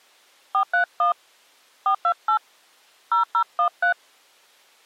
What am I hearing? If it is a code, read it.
DTMF, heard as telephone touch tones, dialled by hand, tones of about 100 ms. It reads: 431 428 0013